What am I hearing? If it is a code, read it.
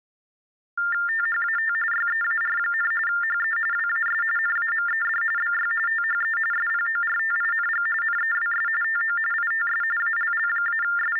TTY/TDD text telephone tones (45.45 baud Baudot), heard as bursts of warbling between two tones, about 400 Hz shift, 1600 Hz centre. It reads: THAT YEAR, HE WAS NAMED BY THE SPORTING NEWS TO ITS …